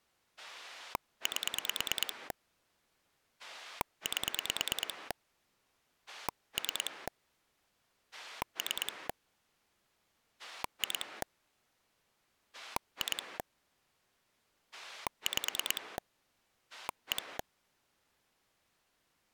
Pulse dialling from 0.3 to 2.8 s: 8

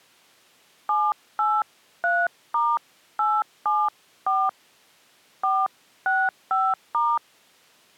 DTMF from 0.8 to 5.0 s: 783*874

